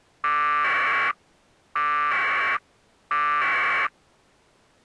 Packet radio (AX.25, as in APRS), 1200 baud, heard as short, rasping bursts.